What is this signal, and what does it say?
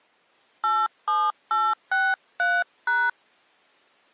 DTMF, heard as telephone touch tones, dialled by hand, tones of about 230 ms. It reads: 87863#